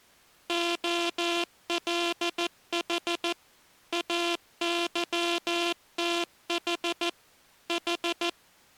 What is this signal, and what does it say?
Morse code (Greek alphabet), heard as a buzzer, machine-sent, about 14 wpm. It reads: ΟΛΗ ΑΥΤΗ Η